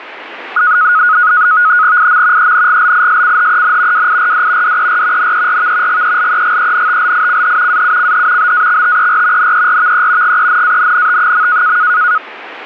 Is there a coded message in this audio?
Yes: NAVTEX (SITOR-B), 100 baud, 170 Hz shift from 0.6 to 12.2 s, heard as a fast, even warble, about 1360 Hz centre, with radio static. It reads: IM ENGLISCHEN WIRD DER NERV GELEGENTLICH AUCH BAXTER NERVE GENANNT.